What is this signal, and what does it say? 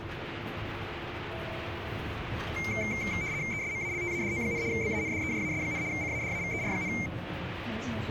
RTTY (75 baud, 170 Hz shift), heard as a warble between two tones, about 2200 Hz centre, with radio static and the noise inside a bus. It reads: ESMALTADO, BANDEJAS, CADAVER,